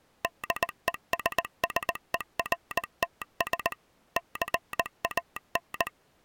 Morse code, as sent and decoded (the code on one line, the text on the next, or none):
-.. . ... ... . .-. - ... / -.-. .- -.
DESSERTS CAN